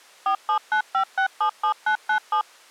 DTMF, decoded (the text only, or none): 4795677997